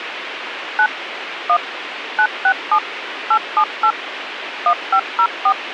DTMF, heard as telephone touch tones, dialled by machine, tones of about 70 ms, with radio hiss. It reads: 9 1 967 878 1504